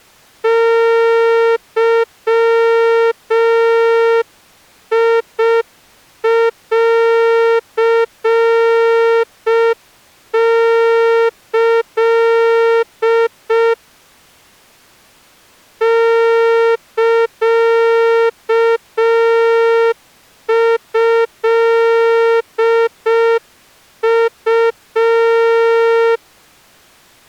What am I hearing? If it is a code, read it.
Morse code (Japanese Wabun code), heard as a horn, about 5 wpm. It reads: ゲンキ サトウ